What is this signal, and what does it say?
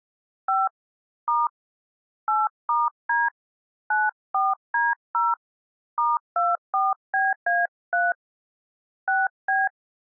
DTMF, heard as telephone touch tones, dialled by hand, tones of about 190 ms. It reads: 5 * 8*D 94D0 *24BA3 6B